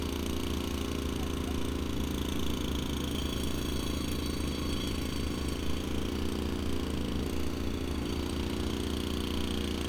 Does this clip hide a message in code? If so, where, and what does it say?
No, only street noise.